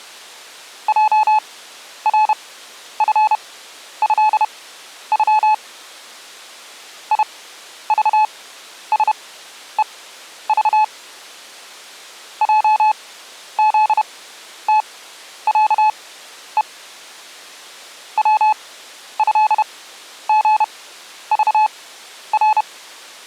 Morse code (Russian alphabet), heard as a keyed tone, machine-sent, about 31 wpm, spaced as for 11 wpm, 860 Hz. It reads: ЙРФЭЮ ИЖСЕЖ ЙЗТЯЕ ВЭГЖР